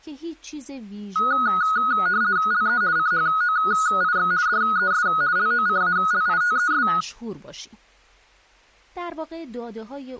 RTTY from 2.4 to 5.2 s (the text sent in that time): LE CHOIX DES